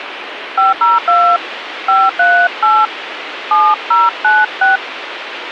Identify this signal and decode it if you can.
DTMF, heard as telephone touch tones, dialled by hand, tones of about 230 ms, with radio hiss. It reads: 502 538 7096